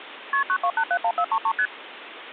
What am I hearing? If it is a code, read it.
Multi-frequency trunk signalling (R1, as on North American trunks), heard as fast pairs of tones, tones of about 70 ms, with phone line noise. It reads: KP 92871433 ST